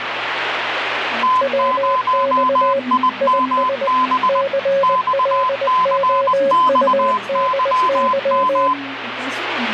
Morse code, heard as two keyed tones, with radio static and the noise of a cafe. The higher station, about 20 wpm, 1020 Hz: T0IMB XCXYM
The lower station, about 20 wpm, 550 Hz: WX IS CLOUDY